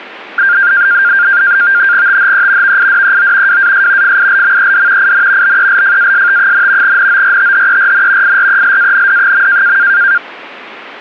NAVTEX (SITOR-B), 100 baud, 170 Hz shift, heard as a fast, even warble, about 1500 Hz centre. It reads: THE VIDEO WAS FILMED IN BELFAST, NORTHERN IRELAND.